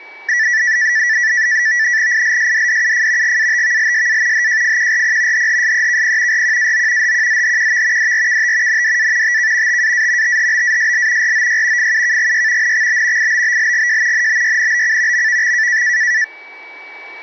NAVTEX (SITOR-B), 100 baud, 170 Hz shift, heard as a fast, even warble, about 1850 Hz centre, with a steady whistle near 2290 Hz. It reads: ILSDDUF GATVLSA HJFQRP HHSEKP RQAO HQZHQV DRKT NDA TK TAA THBASL ROY FUKGY NXB IBBLGJ NBYNBC MVX